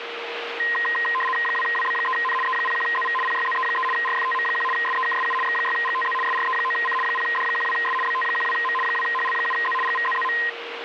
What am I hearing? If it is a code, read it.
RTTY (75 baud, 850 Hz shift), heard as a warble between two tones, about 1460 Hz centre, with radio static and a steady whistle near 470 Hz. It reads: 2WB3N E01ZV PYZE3 RFTM1 SEKSU X6GTZ SRE9C 0D12S BT12M 2HL7Z GVZZM